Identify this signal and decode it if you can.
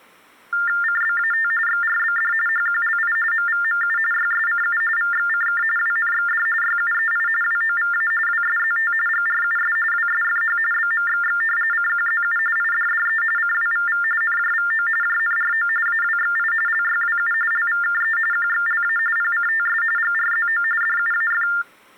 TTY/TDD text telephone tones (45.45 baud Baudot), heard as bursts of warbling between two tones, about 400 Hz shift, 1600 Hz centre. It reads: CBAT XRBD HQLI MVMU YSCU VXCK WNXD YUEI WOVA WSZT GRUS WSFH BMXX CQZU IDDE CWVV NJVO JNRO AWXI LYWU LVKE QXLA PCTS GRZO DUAF